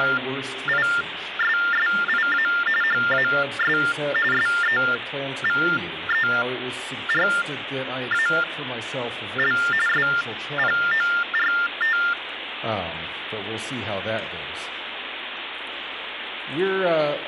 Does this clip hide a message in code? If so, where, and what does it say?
Yes: TTY/TDD text telephone tones (45.45 baud Baudot) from 0.0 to 12.1 s, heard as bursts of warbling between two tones, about 400 Hz shift, 1600 Hz centre, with phone line noise. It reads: … HAS SEVERAL SPORT